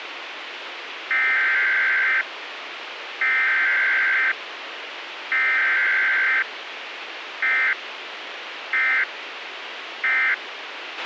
Emergency Alert System (SAME) tones (header bursts, then end-of-message bursts), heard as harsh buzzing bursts, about 520.83 baud, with radio hiss and a squelch burst at the end.